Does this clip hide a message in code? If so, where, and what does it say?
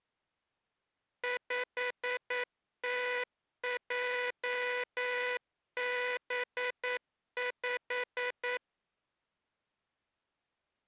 Yes: Morse code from 1.2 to 8.6 s, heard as a buzzer, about 9 wpm. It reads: 5TJB5